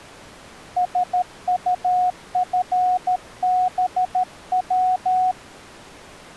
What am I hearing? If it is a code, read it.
Morse code, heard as a keyed tone, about 13 wpm, 730 Hz. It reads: SUFBW